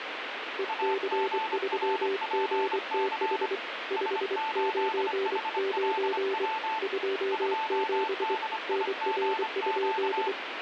Morse code, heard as two keyed tones, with radio static. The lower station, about 24 wpm, 390 Hz: EC3GTH 599 27 NR?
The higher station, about 25 wpm, 880 Hz: AGRPC S8HLW 2DIGQ